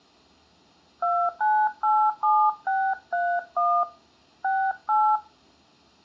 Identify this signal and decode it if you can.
DTMF, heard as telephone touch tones, dialled by hand, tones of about 270 ms, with room echo. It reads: 2987631 68